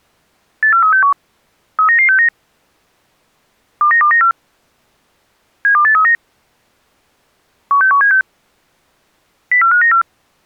Five-tone selective call (CCIR), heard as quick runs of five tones, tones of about 100 ms. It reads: 84361 39969 29294 72839 16176 04594